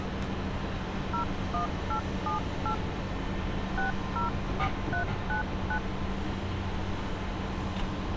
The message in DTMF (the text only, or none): 01878 604399